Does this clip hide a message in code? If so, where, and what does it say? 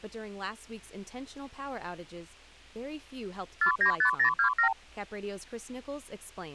Yes: multi-frequency trunk signalling (R2, with the far end's replies) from 3.6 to 4.7 s, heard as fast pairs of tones, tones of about 100 ms. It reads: 495027